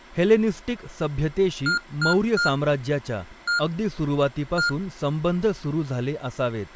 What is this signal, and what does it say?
Beep code, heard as beeps from a small speaker, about 1410 Hz, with speech in Marathi. 3-1-1. In Phoenix BIOS tables: DMA register failure.